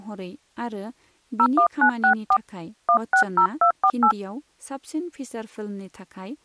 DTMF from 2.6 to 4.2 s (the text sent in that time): 160248